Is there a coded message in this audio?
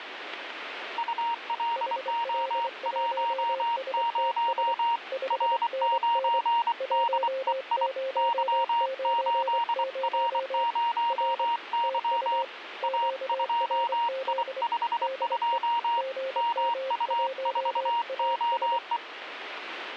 Yes: Morse code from 0.9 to 19.0 s, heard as two keyed tones, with radio static. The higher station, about 24 wpm, 940 Hz: ULO10 R9DEI Y8R0Y A2I52 MU4OE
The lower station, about 24 wpm, 530 Hz: HL1STS 5NN 1090 R TU QRZ DE GM1AS